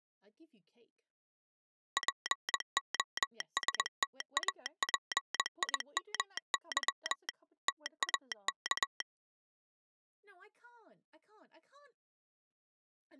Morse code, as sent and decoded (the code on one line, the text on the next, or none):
.--. --- ... - .- .--. .. -- -.-- / - .- -.-
POSTAPIMY TAK